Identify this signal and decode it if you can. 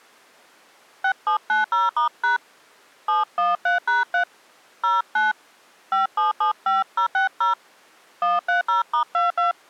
DTMF, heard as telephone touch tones, dialled by hand, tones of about 130 ms. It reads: 6790*# 713#3 09 5775060 130*22